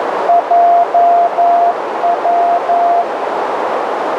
Morse code, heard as a keyed tone, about 11 wpm, 690 Hz, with heavy radio static and a narrow filter. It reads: JW